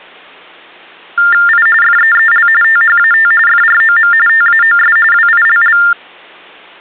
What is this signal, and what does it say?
TTY/TDD text telephone tones (45.45 baud Baudot), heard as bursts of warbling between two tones, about 400 Hz shift, 1600 Hz centre. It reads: I FEEL THAT FROM TAOS WILL